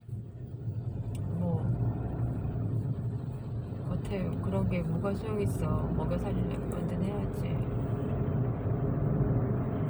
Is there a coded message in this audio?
No, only the noise inside a car.